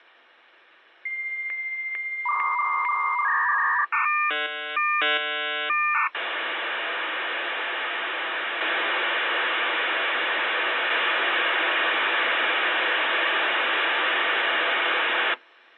Dial-up modem handshake (V.34 or later), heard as a whistle, warbles, then hiss.